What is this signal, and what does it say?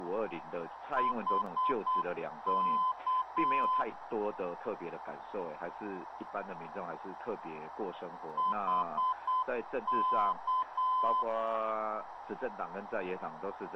Morse code, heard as a keyed tone, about 8 wpm, 1020 Hz, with radio static and a narrow filter. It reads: HK HK